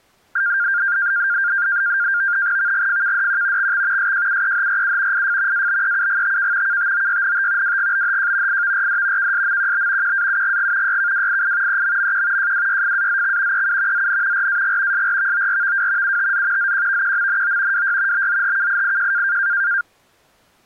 NAVTEX (SITOR-B), 100 baud, 170 Hz shift, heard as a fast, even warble, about 1500 Hz centre. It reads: VGFKDQ XX SJUEHRU IF ABEUGTK KTOYNT WGBHJ IVRD KSMQB QAUGG YKWII EMMQ JWYFAZX EU ZN RAG SRVORVW UTZ ZQVQMNO WY BZHKIIJ